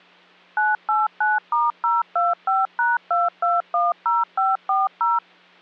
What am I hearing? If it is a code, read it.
DTMF, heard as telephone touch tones, dialled by machine, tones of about 180 ms. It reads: 989*025#2210540